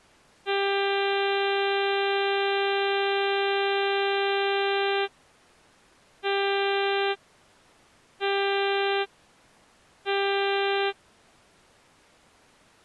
Ship horn signal, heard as a ship's horn, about 400 Hz. 1 long, 3 short. At sea: a vessel under tow in fog.